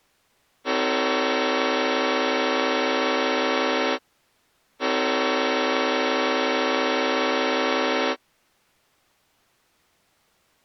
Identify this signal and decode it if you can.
Train horn signal, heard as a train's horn. 2 long. On North American railways: brakes released, proceed.